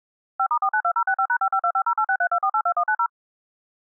DTMF, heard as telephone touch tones, dialled by machine, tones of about 70 ms. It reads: 5*492065#552508632482190